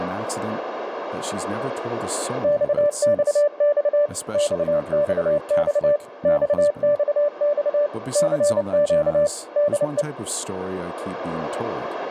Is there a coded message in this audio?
Yes: Morse code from 2.4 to 10.1 s, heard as a keyed tone, machine-sent, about 29 wpm, 590 Hz, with radio static, a narrow filter, room echo and speech in English. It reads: XXX XXX XXX CQ DE